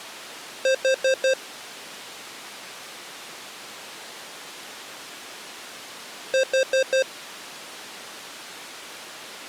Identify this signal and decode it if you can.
Alarm pattern, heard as an alarm's beeps, played twice, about 530 Hz. Temporal four. Carbon monoxide.